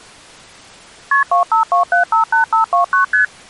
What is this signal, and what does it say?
Multi-frequency trunk signalling (R1, as on North American trunks), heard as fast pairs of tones, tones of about 120 ms. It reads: KP 252758529 ST